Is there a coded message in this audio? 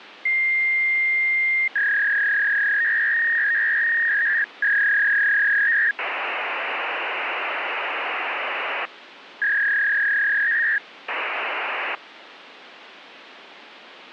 Yes: fax machine handshake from 0.3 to 12.0 s, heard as a long tone, a warble and hiss, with phone line noise.